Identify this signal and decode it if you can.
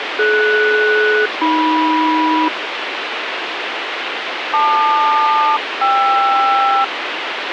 Aircraft SELCAL, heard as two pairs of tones, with radio hiss. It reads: DS-AM LQ-KR